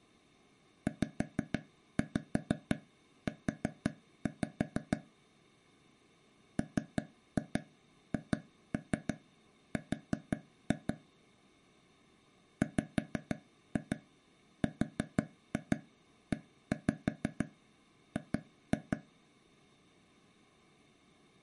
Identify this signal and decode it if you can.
Tap code, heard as taps on a table, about 6 knocks a second. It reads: ZU MHR WREG